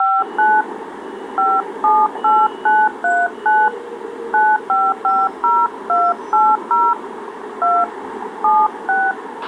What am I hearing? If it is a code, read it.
DTMF, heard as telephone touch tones, dialled by hand, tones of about 220 ms, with a squelch burst at the end and street noise. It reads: 59 578939 9550280 2 76